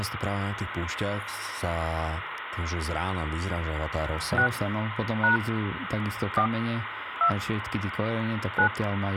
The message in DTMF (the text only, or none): 6 # 4 2 9